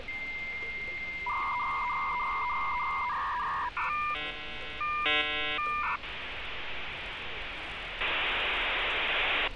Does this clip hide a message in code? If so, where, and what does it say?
Yes: dial-up modem handshake (V.34 or later) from 0.1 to 9.5 s, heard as a whistle, warbles, then hiss, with phone line noise and street noise.